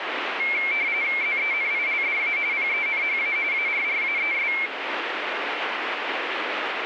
RTTY (45.45 baud, 170 Hz shift), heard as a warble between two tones, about 2250 Hz centre, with radio static. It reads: ZENILDA PENHA ARRAES